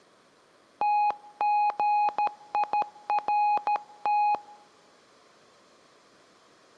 Morse code (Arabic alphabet), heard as a keyed tone, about 13 wpm, 830 Hz, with room echo. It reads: تغيرت